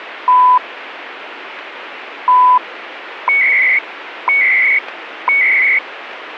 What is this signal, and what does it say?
Radio time signal (CHU, Canada), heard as beeps and data bursts, one a second, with radio static.